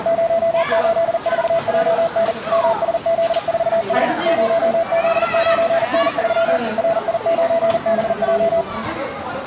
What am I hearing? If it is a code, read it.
Morse code, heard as a keyed tone, machine-sent, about 40 wpm, 670 Hz, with the noise of a park. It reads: 084JN MSZ4S 0Z9N3 RI9BJ